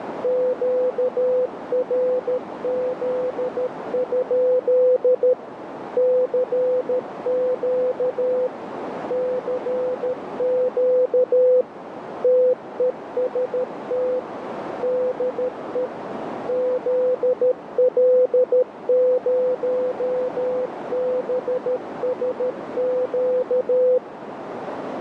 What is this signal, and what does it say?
Morse code, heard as a keyed tone, machine-sent, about 13 wpm, 500 Hz, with radio static and a narrow filter. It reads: QRZ? CQ CQ TEST DE ZL0BSQ